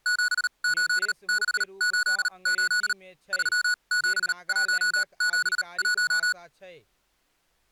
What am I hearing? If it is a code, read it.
Morse code, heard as electronic beeps, machine-sent, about 38 wpm, spaced as for 29 wpm, 1470 Hz, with speech in Maithili. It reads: 78688 37171